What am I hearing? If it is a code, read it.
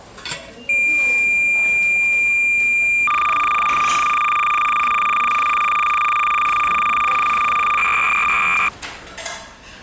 Cassette data (Kansas City type), 300 baud, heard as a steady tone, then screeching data, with the noise of a restaurant.